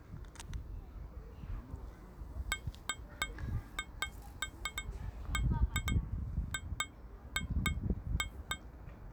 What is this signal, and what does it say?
Irregular taps on glass, with the noise of a residential street. There is no code.